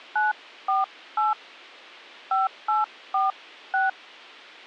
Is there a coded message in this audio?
Yes: DTMF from 0.2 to 3.9 s, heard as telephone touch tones, dialled by hand, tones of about 160 ms. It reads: 948 5846